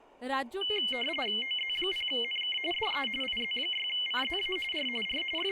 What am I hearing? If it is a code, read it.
RTTY (45.45 baud, 850 Hz shift), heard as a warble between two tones, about 2550 Hz centre, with speech in Bangla. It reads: OZ0NK DE IZ6CZA R R …